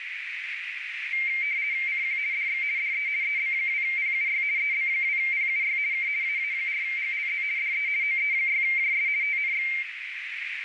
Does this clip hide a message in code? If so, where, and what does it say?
Yes: RTTY (50 baud, 170 Hz shift) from 1.1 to 9.8 s, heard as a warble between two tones, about 2200 Hz centre, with radio static and a narrow filter. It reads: CQ DX DE EB2PUY EB2PUY K AA4GLZ DE OE6JS TNX